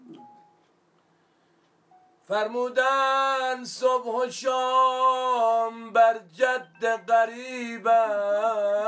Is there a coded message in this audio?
No.